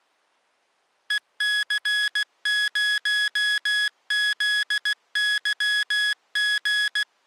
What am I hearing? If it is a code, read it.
Morse code, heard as electronic beeps, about 16 wpm, 1700 Hz. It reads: EC0ZYG